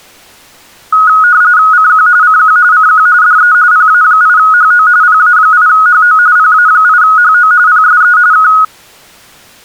RTTY (45.45 baud, 170 Hz shift), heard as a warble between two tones, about 1360 Hz centre. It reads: CQ CQ CQ DE PA8HO PA8HO PA8HO PSE K